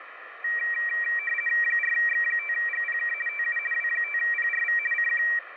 RTTY (50 baud, 450 Hz shift), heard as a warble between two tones, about 2100 Hz centre, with radio static. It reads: 4X5GPK TU W5PRV CQ